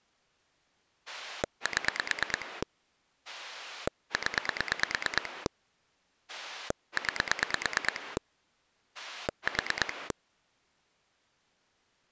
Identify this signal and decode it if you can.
Pulse dialling, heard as a rotary dial, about 9 pulses a second. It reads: 7 0 9 4